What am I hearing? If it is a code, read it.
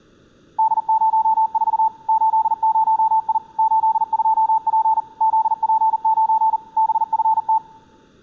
Morse code, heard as a keyed tone, machine-sent, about 40 wpm, 880 Hz. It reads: D04 80I 82P ZP9 BFT